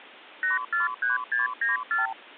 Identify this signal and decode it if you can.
Multi-frequency trunk signalling (R2, with the far end's replies), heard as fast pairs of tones, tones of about 150 ms. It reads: 843694